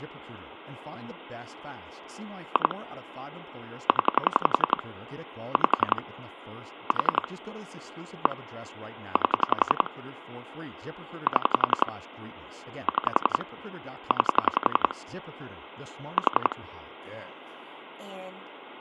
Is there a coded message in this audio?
Yes: pulse dialling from 2.6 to 16.5 s, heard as clicks on a phone line, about 11 pulses a second, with speech in English. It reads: 2 0 5 4 1 8 7 6 9 4